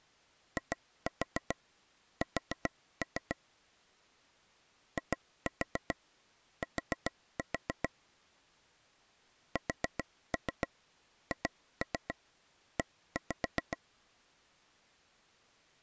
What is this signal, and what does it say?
Tap code, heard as taps on a table, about 7 knocks a second. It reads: IS IT SHE